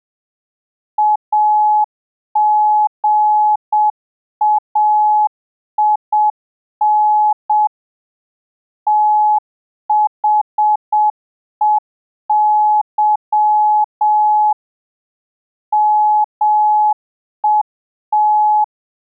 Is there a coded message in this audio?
Yes: Morse code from 0.9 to 18.7 s, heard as a keyed tone, machine-sent, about 7 wpm, 850 Hz. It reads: AGAIN THEY MET